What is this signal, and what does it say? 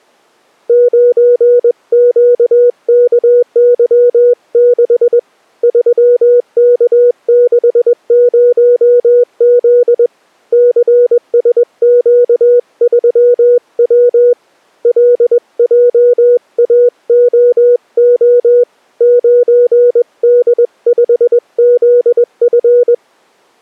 Morse code, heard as a keyed tone, hand-sent with a paddle, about 21 wpm, 490 Hz. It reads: 9QKY6 3K60Z CSQ3W LJAOO 9D5ZF